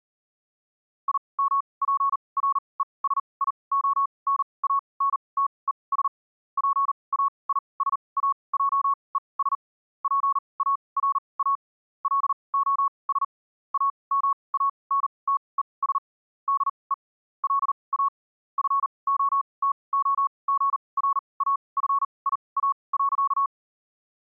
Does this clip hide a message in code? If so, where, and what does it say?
Yes: Morse code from 1.0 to 23.5 s, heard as a keyed tone, machine-sent, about 39 wpm, spaced as for 26 wpm, 1110 Hz. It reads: IMPRESIONANTES PAISAJES PARA LOS AMANTES DE LA FOTOGRAFIA.